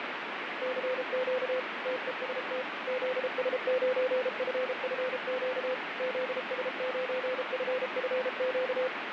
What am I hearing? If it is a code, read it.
Morse code, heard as a keyed tone, machine-sent, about 33 wpm, 510 Hz, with heavy radio static. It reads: CQ TEST ZS9FFQ ZS9FFQ